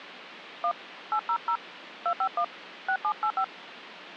DTMF, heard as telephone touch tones, dialled by hand, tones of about 80 ms, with phone line noise. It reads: 1 800 251 6785